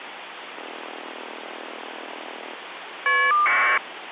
Caller ID data burst, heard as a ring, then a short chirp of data, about 1200 baud, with phone line noise.